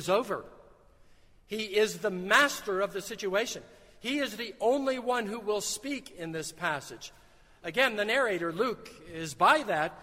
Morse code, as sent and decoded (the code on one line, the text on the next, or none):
none